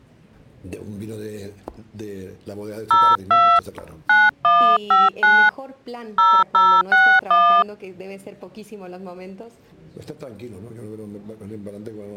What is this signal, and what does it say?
DTMF, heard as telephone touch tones, dialled by hand, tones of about 250 ms. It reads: 02 9159 0061